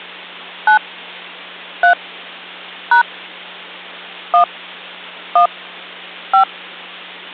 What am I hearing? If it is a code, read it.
DTMF, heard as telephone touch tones, dialled by hand, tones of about 100 ms, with hum. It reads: 9 3 # 1 1 5